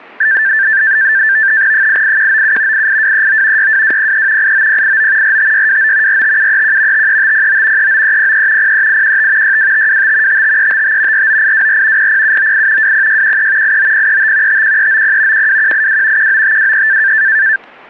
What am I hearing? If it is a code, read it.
NAVTEX (SITOR-B), 100 baud, 170 Hz shift, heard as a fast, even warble, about 1650 Hz centre, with static crashes. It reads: 88197 88239 62203 89089 45629 45731 53509 39303 03815 62525 55355 49824 00798 20613 89035 51390 12182 19523